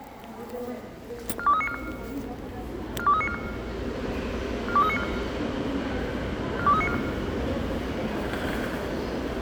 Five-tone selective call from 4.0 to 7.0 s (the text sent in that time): 42394 42394